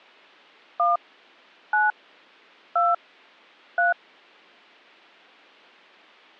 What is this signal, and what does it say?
DTMF, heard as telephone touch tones, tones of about 170 ms. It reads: 1 9 2 3